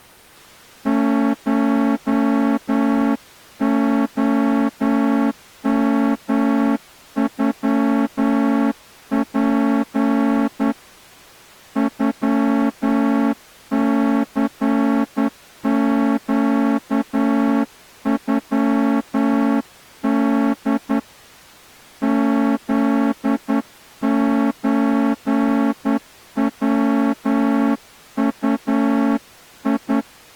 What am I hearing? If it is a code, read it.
Morse code (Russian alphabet), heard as a horn, hand-sent with a straight key, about 10 wpm. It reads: ШОМЮП ЮЦЩЮД ЗЧВУИ